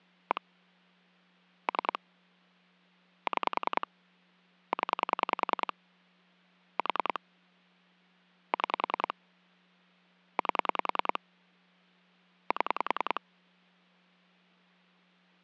Pulse dialling, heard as clicks on a phone line, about 10 pulses a second, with hum. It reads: 1 3 6 0 4 6 8 7